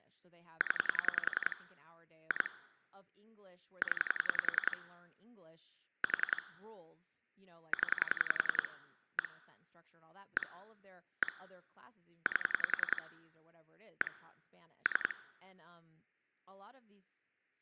Pulse dialling, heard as clicks on a phone line, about 10 pulses a second, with speech in English. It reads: 0 2 0 4 0 1 1 1 8 1 3